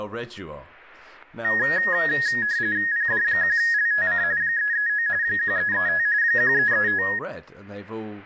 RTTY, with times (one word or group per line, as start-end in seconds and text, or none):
2.9-4.2 PD1LTC
4.4-5.1 339
5.2-6.1 1335
6.2-7.0 1335